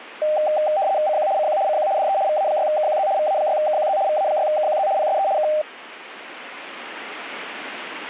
RTTY (75 baud, 170 Hz shift), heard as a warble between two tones, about 700 Hz centre. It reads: CQ CQ CQ DE VA6KQZ VA6KQZ VA6KQZ PSE K